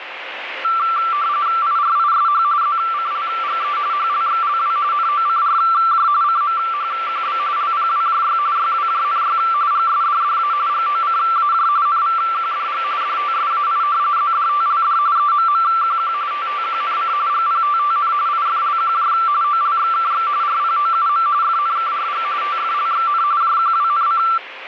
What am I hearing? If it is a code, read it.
RTTY (45.45 baud, 170 Hz shift), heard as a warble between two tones, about 1260 Hz centre, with radio static. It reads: IRISH ZCLGE HLXLW NOCRJ CMHQB LPWJY YWJNY GSDDA GOCAJ NVQDG DTSAI ZDTLD EMMQQ TTQNC GPTTN IFLQJ OLXKX RPOUM FNKRG TFLXN JQWNC